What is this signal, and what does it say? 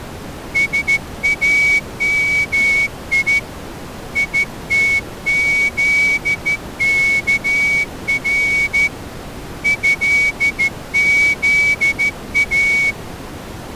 Morse code (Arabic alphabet), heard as a whistle, hand-sent with a straight key, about 13 wpm. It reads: سامي يتذكر هذا